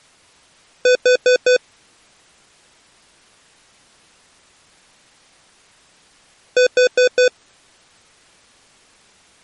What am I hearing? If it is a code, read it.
Alarm pattern, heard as an alarm's beeps, played twice, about 500 Hz. Temporal four. Carbon monoxide.